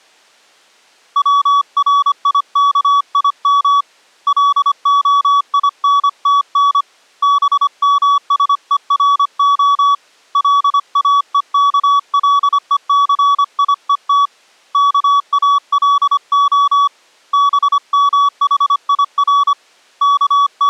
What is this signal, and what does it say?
Morse code (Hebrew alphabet), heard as a keyed tone, hand-sent with a paddle, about 25 wpm, 1140 Hz. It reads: צריכים להינתן במשורה לאוכלוסיות כאלה במחיר …